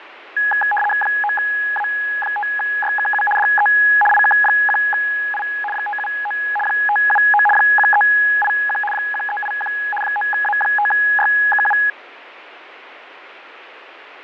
RTTY (75 baud, 850 Hz shift), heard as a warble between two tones, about 1250 Hz centre, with radio static and fading. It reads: 9A5YKU DE IK1I 579 579 1381 1381 9A5YKU